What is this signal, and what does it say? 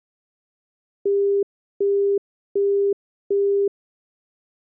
Telephone call progress tone (as in the UK, Australia and similar networks), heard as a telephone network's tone, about 400 Hz, 0.375 s on and 0.375 s off. Busy tone.